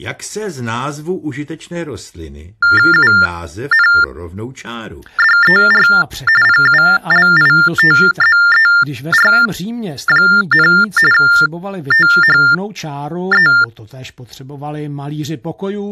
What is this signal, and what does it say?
TTY/TDD text telephone tones (45.45 baud Baudot), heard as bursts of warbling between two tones, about 400 Hz shift, 1600 Hz centre, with speech in Czech. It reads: UNDER PULITZER, THE